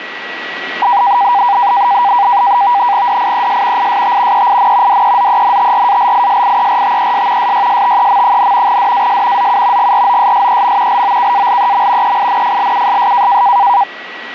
NAVTEX (SITOR-B), 100 baud, 170 Hz shift, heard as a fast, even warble, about 880 Hz centre, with radio static and a steady whistle near 1930 Hz. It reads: DIES IST EIN DEZENTRALISIERTES SYSTEM, DAS ZU GROSSEM LOKALEM EINFLUSS